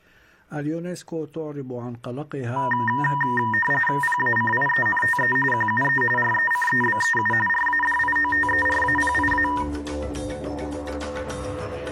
RTTY (45.45 baud, 850 Hz shift), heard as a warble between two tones, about 1410 Hz centre. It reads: PACIENTE QUE RECEBEU RADIOTERAPIA